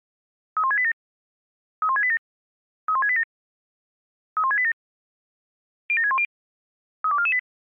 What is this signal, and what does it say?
Five-tone selective call (ZVEI), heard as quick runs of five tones, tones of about 70 ms. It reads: 31687 31687 31687 31687 07610 32448